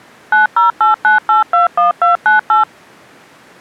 DTMF, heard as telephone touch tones, dialled by machine, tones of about 140 ms. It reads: 9089821298